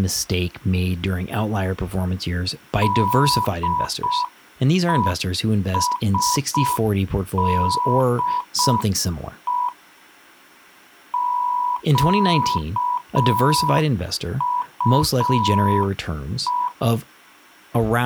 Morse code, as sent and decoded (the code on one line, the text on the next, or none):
-.. . ... -.. . / --.- ..- .
DESDE QUE